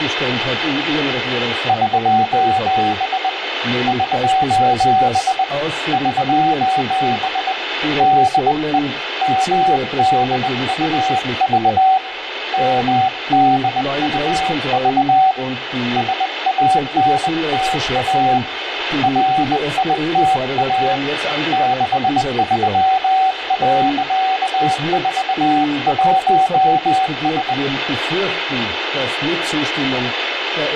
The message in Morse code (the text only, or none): <SOS> <SOS> <SOS> DE MDUV MDUV SANTA RITA 63.41S